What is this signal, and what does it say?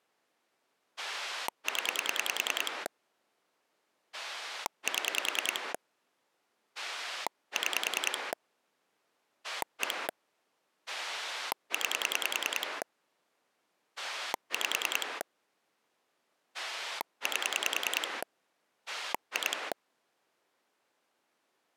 Pulse dialling, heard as a rotary dial, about 10 pulses a second. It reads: 0 7 6 1 9 5 8 2